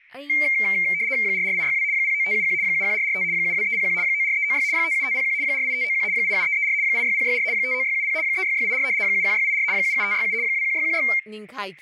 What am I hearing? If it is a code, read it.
RTTY (75 baud, 170 Hz shift), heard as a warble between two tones, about 2200 Hz centre, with static crashes and speech in Manipuri. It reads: 44862 09571 71445 72301 94396 57501 48591 87334 86064 59670 36684 71684 77567 21616